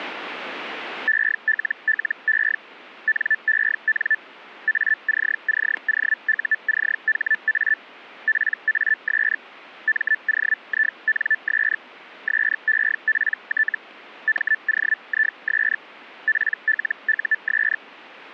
Hellschreiber (Feld-Hell, 122.5 baud), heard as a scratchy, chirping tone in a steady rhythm, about 1750 Hz, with static crashes. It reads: ELLE NEN ACCOUCHA PAS MOINS SEPT MOIS PLUS